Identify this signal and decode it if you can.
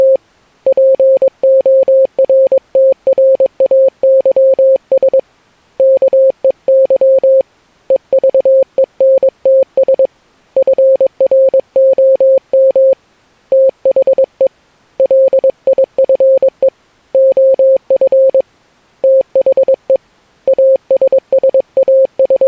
Morse code, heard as a keyed tone, hand-sent with a paddle, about 22 wpm, 530 Hz. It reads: … PORTRAYS KEY EVENTS FROM THE LIFE OF THE …